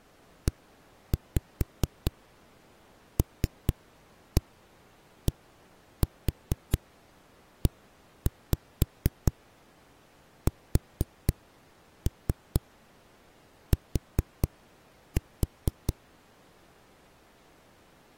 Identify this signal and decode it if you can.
Tap code, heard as knocks on a wall, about 4 knocks a second. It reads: ELDEST